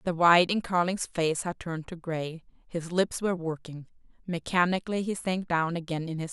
Speech in English. There is no code.